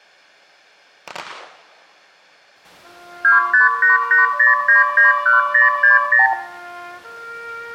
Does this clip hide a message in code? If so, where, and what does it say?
Yes: multi-frequency trunk signalling (R2, with the far end's replies) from 3.2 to 6.3 s, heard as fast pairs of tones, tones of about 140 ms, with room echo. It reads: 25880991060